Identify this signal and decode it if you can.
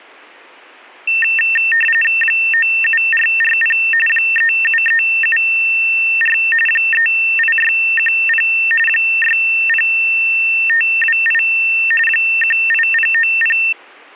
RTTY (45.45 baud, 850 Hz shift), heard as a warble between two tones, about 2250 Hz centre. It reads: 97440 37374 38610 60528 18090